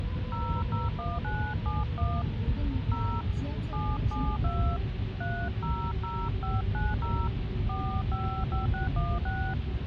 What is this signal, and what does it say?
DTMF, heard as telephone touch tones, dialled by hand, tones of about 230 ms, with phone line noise and the noise inside a car. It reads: 001971 0 772 300590 455616